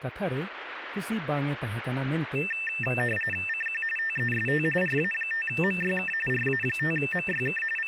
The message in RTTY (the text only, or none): CQ TEST RA5MYK RA5MYK …